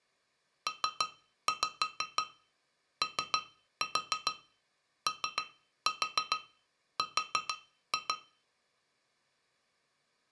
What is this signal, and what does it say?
Tap code, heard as taps on glass, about 6 knocks a second. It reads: POOR